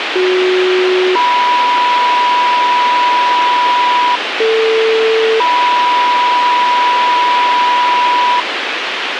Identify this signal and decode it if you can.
Two-tone page, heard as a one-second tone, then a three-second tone, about 370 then 980 Hz, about 450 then 980 Hz, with radio hiss and a squelch burst at the end.